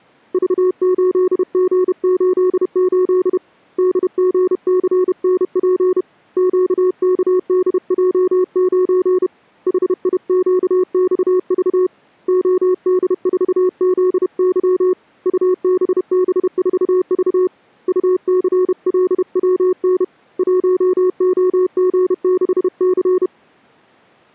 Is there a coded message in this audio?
Yes: Morse code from 0.3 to 23.3 s, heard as a keyed tone, hand-sent with a paddle, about 31 wpm, 370 Hz. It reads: V8G88 DGCNP QKDJ9 HIQXV OD4ZY UBB4V UCLWN 1OG6C